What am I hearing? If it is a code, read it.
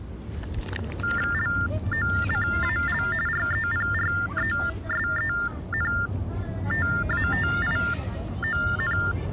TTY/TDD text telephone tones (45.45 baud Baudot), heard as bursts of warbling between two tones, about 400 Hz shift, 1600 Hz centre, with the noise of a residential street. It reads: LOCAL REPRESENTATION